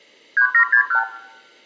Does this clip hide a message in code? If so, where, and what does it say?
Yes: multi-frequency trunk signalling (R2, with the far end's replies) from 0.4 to 1.0 s, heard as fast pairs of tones, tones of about 90 ms. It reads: 3761